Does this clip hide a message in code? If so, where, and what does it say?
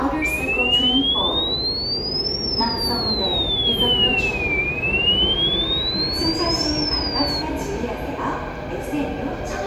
No, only a tone that sweeps in pitch again and again, with the noise of a subway station.